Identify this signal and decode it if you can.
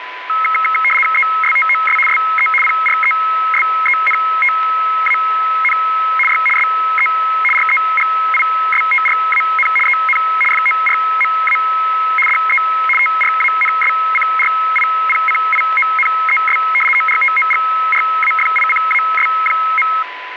RTTY (75 baud, 850 Hz shift), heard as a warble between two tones, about 1700 Hz centre, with radio static and a steady whistle near 1000 Hz. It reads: ESTOS SE PRESENTAN Y SE REGISTRAN EN FORMA DE TRANSCRIPCIONES ORTOGRAFICAS.